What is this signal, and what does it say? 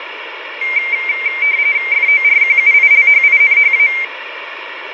RTTY (45.45 baud, 170 Hz shift), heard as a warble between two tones, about 2200 Hz centre, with radio static and room echo. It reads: FORQUILHINHA